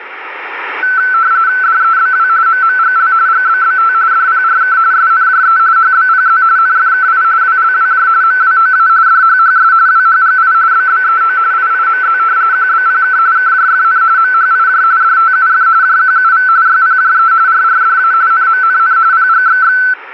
RTTY (45.45 baud, 170 Hz shift), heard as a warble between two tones, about 1420 Hz centre, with radio static. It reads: DEBW MMGL GBBT DPRK SNJE HBPZ NFKI WLWJ MWOA DHHS WHGI BBEO IIMZ QBPK KJFN MHIJ DTUF JQUV YPJE RRDA NMNN PGXX